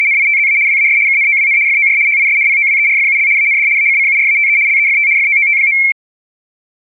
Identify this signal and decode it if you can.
RTTY (75 baud, 170 Hz shift), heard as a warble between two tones, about 2250 Hz centre. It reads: … WAS KNOWN FOR HIS POWERFUL AND ACCURATE LEFT FOOT.